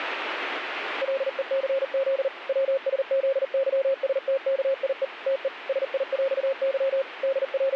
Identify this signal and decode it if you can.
Morse code (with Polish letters), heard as a keyed tone, machine-sent, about 39 wpm, 540 Hz, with radio static. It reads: LECZ WSZYSTKIE TE SIŁY …